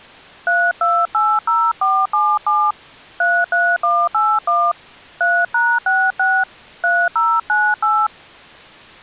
DTMF, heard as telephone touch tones, dialled by hand, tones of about 240 ms. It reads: 3280477 33181 3#66 3098